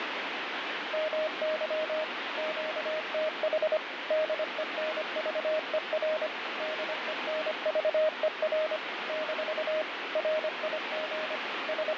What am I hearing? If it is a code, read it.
Morse code, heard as a keyed tone, machine-sent, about 25 wpm, 620 Hz, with heavy radio static. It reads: MY QTH DENVER DENVER - RIG …